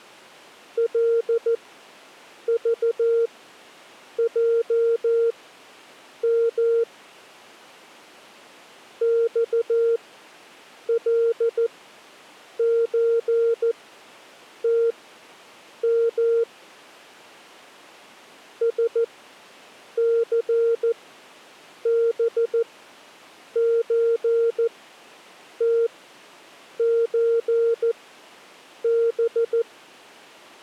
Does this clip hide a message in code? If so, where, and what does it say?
Yes: Morse code (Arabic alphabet) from 0.7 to 29.7 s, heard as a keyed tone, machine-sent, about 14 wpm, spaced as for 7 wpm, 460 Hz. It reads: لضجم صلزتم سثبزتزب